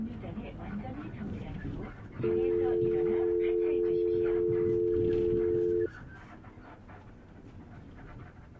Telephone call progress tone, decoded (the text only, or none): dial tone